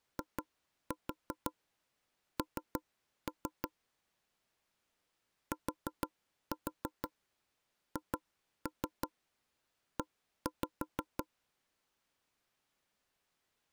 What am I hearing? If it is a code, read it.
Tap code, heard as knocks on wood, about 6 knocks a second. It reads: IN THE